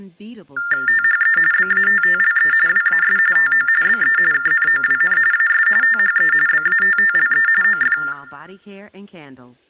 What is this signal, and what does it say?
TTY/TDD text telephone tones (45.45 baud Baudot), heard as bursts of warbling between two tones, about 400 Hz shift, 1600 Hz centre, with speech in English. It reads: THE BATTLE WAS TO BE KNOWN AS THE BATTLE OF